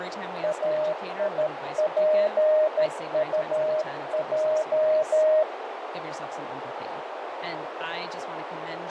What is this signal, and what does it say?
Morse code, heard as a keyed tone, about 13 wpm, 620 Hz, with heavy radio static, a narrow filter and speech in English. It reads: AIPUJ